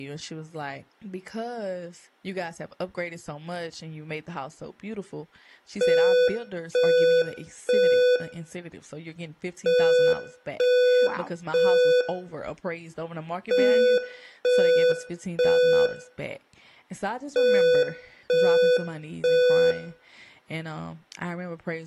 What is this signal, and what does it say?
Alarm pattern, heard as an alarm's beeps, played four times, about 500 Hz, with room echo and speech in English. Temporal three. Smoke or fire, evacuate.